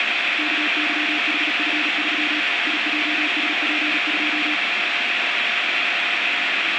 Morse code, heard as a keyed tone, hand-sent with a paddle, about 37 wpm, 300 Hz, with radio static. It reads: KYHF3 IJSP2